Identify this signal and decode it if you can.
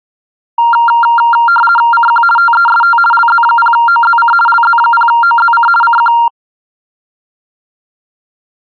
RTTY (50 baud, 450 Hz shift), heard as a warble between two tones, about 1160 Hz centre. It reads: CQ TEST LZ0OZC LZ0OZC CQ